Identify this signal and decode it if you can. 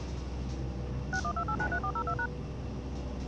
DTMF, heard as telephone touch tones, dialled by machine, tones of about 70 ms, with the noise inside a lift. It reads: 612893402#